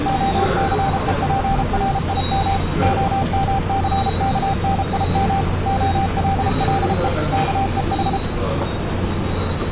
Morse code (Hebrew alphabet), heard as a keyed tone, machine-sent, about 33 wpm, 780 Hz, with the noise of a subway station. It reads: הסופרים המסכנים הללו כוח